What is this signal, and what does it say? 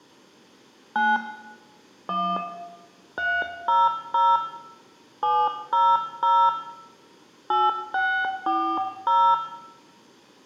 DTMF, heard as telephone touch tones, dialled by hand, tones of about 250 ms, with room echo. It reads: 9 1 300 700 8640